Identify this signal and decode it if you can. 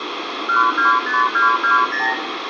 Multi-frequency trunk signalling (R2, with the far end's replies), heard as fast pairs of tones, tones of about 140 ms, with phone line noise and room echo. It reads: 125220